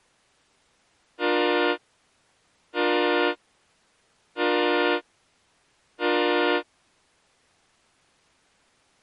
Train horn signal, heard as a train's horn. 4 short. On North American railways: a request for a signal to be given or repeated.